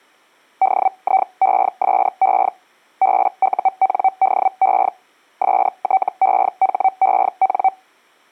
Hellschreiber (Feld-Hell, 122.5 baud), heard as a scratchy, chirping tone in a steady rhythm, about 760 Hz. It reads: DIESE BUNDE STEHEN